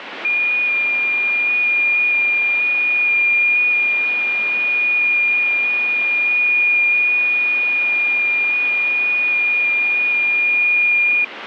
FT8 (one signal), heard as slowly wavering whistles, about 6.25 baud, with radio static.